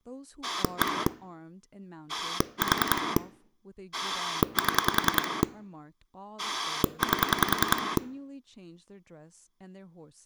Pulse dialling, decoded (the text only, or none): 1 4 7 8